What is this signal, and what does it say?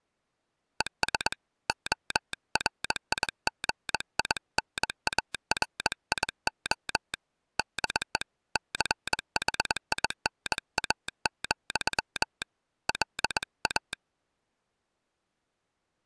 Morse code, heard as a telegraph sounder, hand-sent with a straight key, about 21 wpm. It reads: ES ORIGINARIO DE CHINA, LA